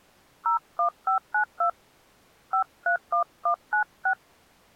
DTMF, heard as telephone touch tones, dialled by hand, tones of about 100 ms. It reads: 01592 531196